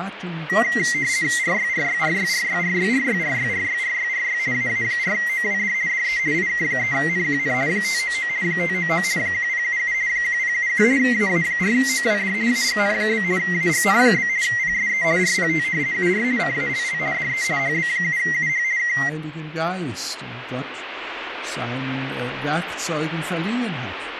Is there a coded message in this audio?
Yes: RTTY (50 baud, 170 Hz shift) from 0.5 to 19.1 s, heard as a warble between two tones, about 2000 Hz centre, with radio static. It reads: RYRYRYRYRYRYRYRYRYRY AA4OWD DE IK3NQN 599 599 1077 1077 AA4OWD AGN? AGN? PSE RPT UR CALL DE HB7UH K